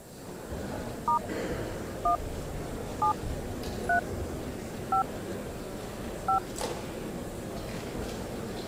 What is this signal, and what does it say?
DTMF, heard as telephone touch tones, dialled by hand, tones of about 100 ms. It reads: * 1 7 3 5 5